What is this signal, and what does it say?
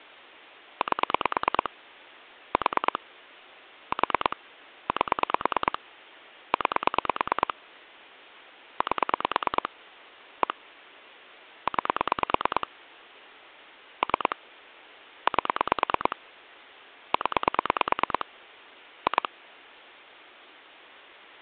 Pulse dialling, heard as clicks on a phone line, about 9 pulses a second. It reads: 8 4 4 8 9 8 1 9 3 8 0 2